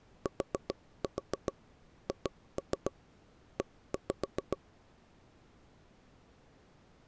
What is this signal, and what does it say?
Tap code, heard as taps on a table, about 7 knocks a second. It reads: THE